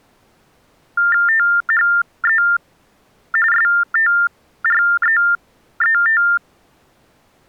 TTY/TDD text telephone tones (45.45 baud Baudot), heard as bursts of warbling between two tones, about 400 Hz shift, 1600 Hz centre. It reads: THE STREET